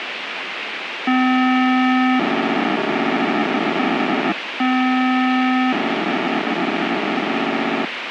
POCSAG pager data (512 baud), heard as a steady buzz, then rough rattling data, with radio hiss.